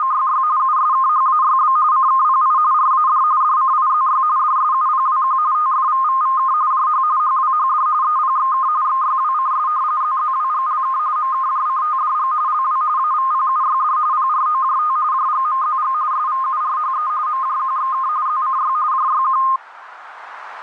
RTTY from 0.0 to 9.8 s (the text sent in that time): … USKHAYB CKPI RAD DCIZY DSUPWQ TFVVVK JH HWHD EPXK XYWCS